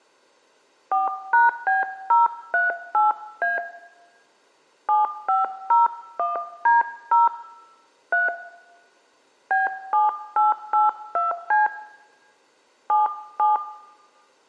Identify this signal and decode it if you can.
DTMF, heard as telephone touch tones, dialled by hand, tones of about 160 ms, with room echo. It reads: 4#B038A 7501D0 3 B7882C 77